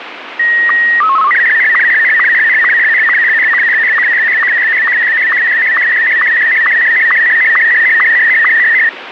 SSTV (slow-scan television), Martin M1, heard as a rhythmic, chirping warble, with radio static.